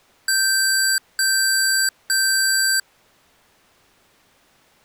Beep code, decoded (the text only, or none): 3 long